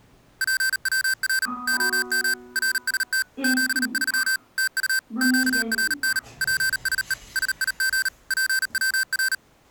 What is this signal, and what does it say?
Morse code, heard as electronic beeps, machine-sent, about 38 wpm, 1550 Hz, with the noise inside a lift. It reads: PWR OM RST 73 TU QRN PSE SIG PWR